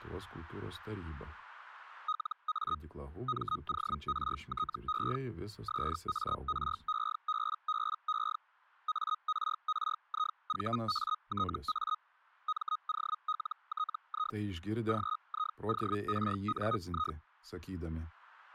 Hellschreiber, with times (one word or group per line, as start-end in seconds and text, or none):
2.1-2.8 LA
3.3-5.2 MORTE
5.7-8.4 SAREBBE
8.9-12.0 ARRIVATA
12.5-14.4 MOLTI
14.9-17.2 GIORNI